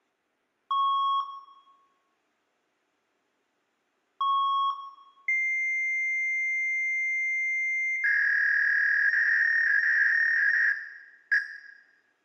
Fax machine handshake, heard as beeps, a long tone and a warble, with room echo.